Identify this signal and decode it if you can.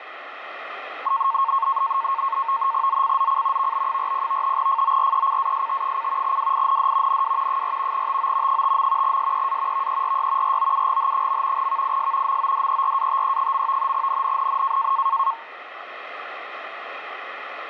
NAVTEX (SITOR-B), 100 baud, 170 Hz shift, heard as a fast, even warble, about 1000 Hz centre, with radio static. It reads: ZCZC VB40 FORECAST: WIND NW 4 TO 5. SEA VERY ROUGH. VIS MODERATE. NNNN